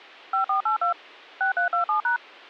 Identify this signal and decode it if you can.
DTMF, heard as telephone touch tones, dialled by machine, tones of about 110 ms. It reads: 5482 6327#